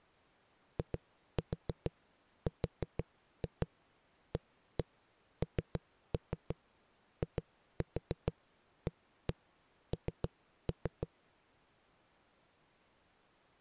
Tap code, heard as knocks on a wall, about 6 knocks a second. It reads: IRANIAN